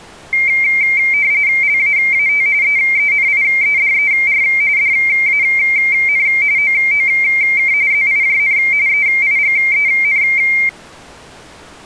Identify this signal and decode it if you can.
RTTY (45.45 baud, 170 Hz shift), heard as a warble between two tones, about 2200 Hz centre. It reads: LAAT EENIEDER DAN OOK ZIJN EIGEN